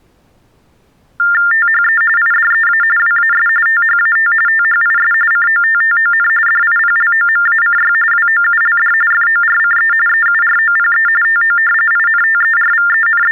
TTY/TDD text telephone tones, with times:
1.5-2.0 THE
2.2-2.8 IDEA
3.0-3.5 WAS
3.7-4.3 THAT
4.5-5.1 THIS
5.3-6.3 COTTON
6.5-7.9 DIPLOMACY
8.1-8.9 WOULD
9.1-9.9 FORCE
10.1-11.1 EUROPE
11.2-11.6 TO
11.9-13.3 …

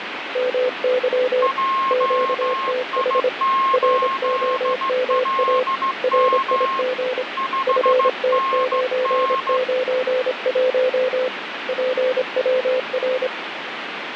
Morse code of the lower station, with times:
0.4-1.5 MY
1.9-3.3 QTH
3.7-5.6 ROMA
6.0-7.2 RIG
7.7-11.3 FT991
11.7-13.3 PWR

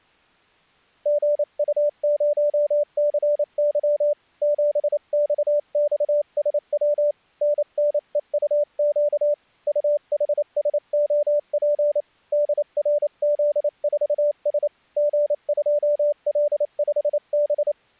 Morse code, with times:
1.1-4.1 GU0CY
4.4-7.1 7XXSW
7.4-9.3 NNEUQ
9.7-12.0 UHSOP
12.3-14.7 DRZ4S
15.0-17.7 G2L5B

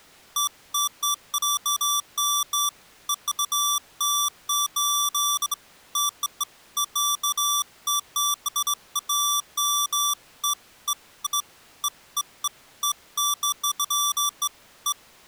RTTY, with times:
none

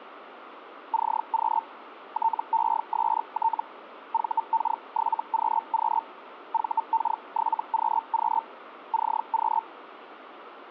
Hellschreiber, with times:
0.9-1.6 CQ
2.1-3.6 TEST
4.1-6.0 VK7QQ
6.5-8.4 VK7QQ
8.9-9.6 CQ

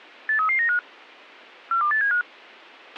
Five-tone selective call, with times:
0.3-0.8 83395
1.7-2.2 42875

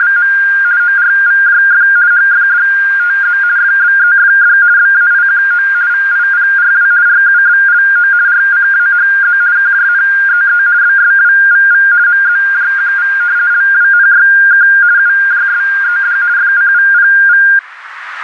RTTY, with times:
0.0-0.3 …
0.8-1.9 ORVJF
2.1-3.4 HFDTZ
3.6-4.6 FBEFD
4.8-5.7 BAIQO
5.9-6.9 VIPRW
7.1-8.1 RUBLO
8.3-9.4 RCAHZ
9.6-10.6 KJNEE
10.8-11.9 BSWVV
12.1-13.1 MZJQV
13.5-14.7 LWNYK
15.0-16.2 UJSED
16.4-17.4 FCVPV

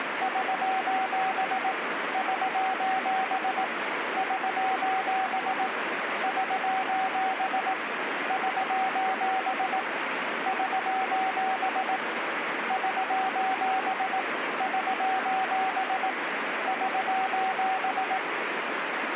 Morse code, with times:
0.2-1.7 <SOS>
2.1-3.6 <SOS>
4.2-5.7 <SOS>
6.2-7.7 <SOS>
8.3-9.8 <SOS>
10.5-12.0 <SOS>
12.7-14.2 <SOS>
14.6-16.1 <SOS>
16.7-18.2 <SOS>

